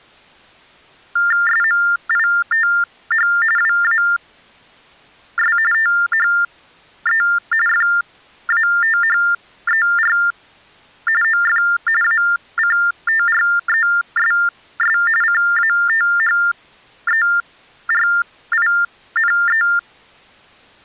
TTY/TDD text telephone tones (45.45 baud Baudot), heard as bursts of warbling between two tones, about 400 Hz shift, 1600 Hz centre. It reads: SMITH WAS THE FATHER OF ACTRESS CATHERINE